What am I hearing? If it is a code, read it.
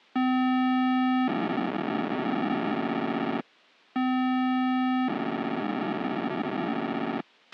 POCSAG pager data (512 baud), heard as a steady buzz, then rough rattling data, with a squelch burst at the end.